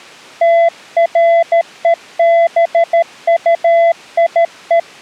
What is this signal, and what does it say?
Morse code, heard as a keyed tone, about 13 wpm, 670 Hz. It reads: TREBUIE